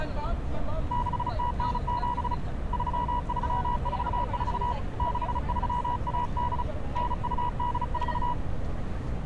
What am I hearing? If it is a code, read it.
Morse code (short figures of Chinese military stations), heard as a keyed tone, hand-sent with a paddle, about 35 wpm, 970 Hz, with street noise. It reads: 6097 3344 6318 9284